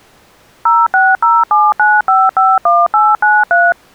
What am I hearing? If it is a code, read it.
DTMF, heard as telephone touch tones, dialled by machine, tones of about 210 ms. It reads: 06079551893